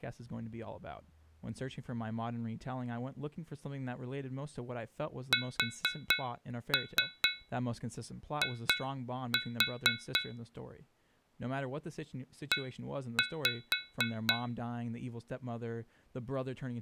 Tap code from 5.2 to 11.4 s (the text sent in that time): SI